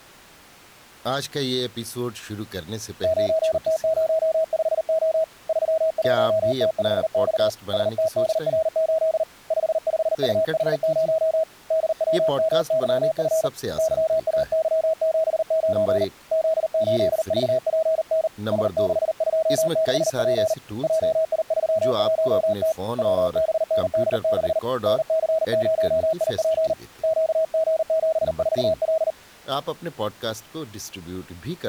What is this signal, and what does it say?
Morse code, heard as a keyed tone, hand-sent with a paddle, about 39 wpm, 640 Hz, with speech in Urdu. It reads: 9T05O 31T5X STDR8 55UH0 DWMYF YAY79 Z8VPN S626P JI31T WBND6 NC0IP QG74L